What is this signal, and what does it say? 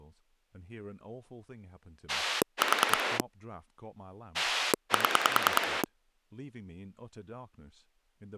Pulse dialling, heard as a rotary dial, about 10 pulses a second, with speech in English. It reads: 4 7